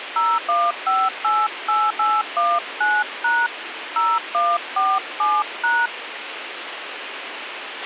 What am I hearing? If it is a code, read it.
DTMF, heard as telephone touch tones, dialled by hand, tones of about 220 ms, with radio hiss and a squelch burst at the end. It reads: 01588819# 0147#